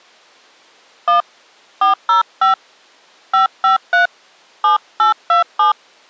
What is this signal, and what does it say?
DTMF, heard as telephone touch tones, dialled by hand, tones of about 130 ms. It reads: 1 405 553 7827